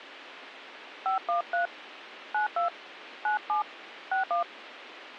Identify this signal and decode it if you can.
DTMF, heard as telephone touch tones, dialled by hand, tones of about 120 ms, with radio hiss. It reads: 513 92 97 61